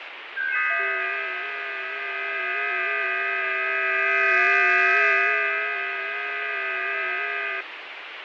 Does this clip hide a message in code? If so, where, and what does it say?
Yes: FT8 (several signals at once) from 0.4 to 7.6 s, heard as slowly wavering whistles, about 6.25 baud, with heavy radio static and fading.